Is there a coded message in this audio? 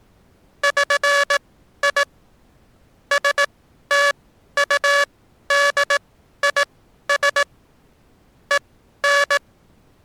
Yes: Morse code (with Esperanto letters) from 0.6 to 9.4 s, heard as a buzzer, machine-sent, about 18 wpm, spaced as for 12 wpm. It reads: ŜI STUDIS EN